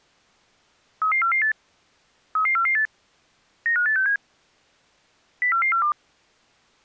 Five-tone selective call (CCIR), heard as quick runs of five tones, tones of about 100 ms. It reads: 33448 33448 95867 04442